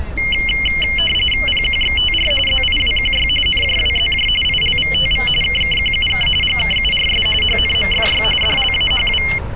RTTY (45.45 baud, 850 Hz shift), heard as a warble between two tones, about 2550 Hz centre, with street noise. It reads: PQXTR ZIWQY NJWZJ ILVTV KKQUK GKURS HNMFY DLAHW